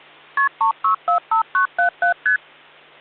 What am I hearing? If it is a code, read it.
Multi-frequency trunk signalling (R1, as on North American trunks), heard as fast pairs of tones, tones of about 110 ms, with hum. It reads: KP 3645977 ST